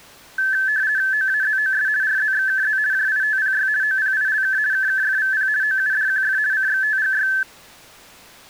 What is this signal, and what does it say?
RTTY (50 baud, 170 Hz shift), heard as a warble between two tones, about 1650 Hz centre. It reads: OAZOS RZXKZ JITPY OPILK KKFVP OUDQF CXTGY